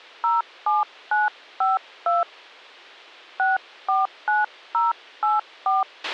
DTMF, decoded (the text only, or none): 07952 649084